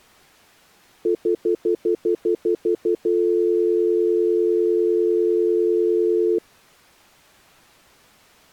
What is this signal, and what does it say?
Telephone call progress tone (North American plan), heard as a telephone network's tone, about 350, 440 Hz, 0.1 s on and 0.1 s off. Stutter dial tone.